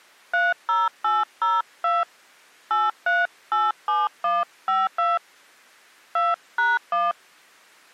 DTMF, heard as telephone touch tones, dialled by hand, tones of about 190 ms. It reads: 30802 8387152 2#1